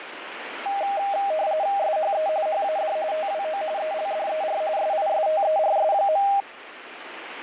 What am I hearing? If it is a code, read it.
RTTY (45.45 baud, 170 Hz shift), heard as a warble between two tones, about 710 Hz centre, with radio static. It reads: SHE HAD TWO ELDER SISTERS.